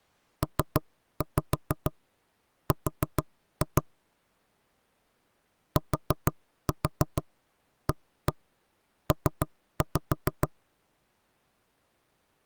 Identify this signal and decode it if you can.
Tap code, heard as knocks on wood, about 6 knocks a second. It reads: PR TAP